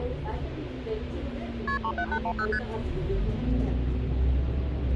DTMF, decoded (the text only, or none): none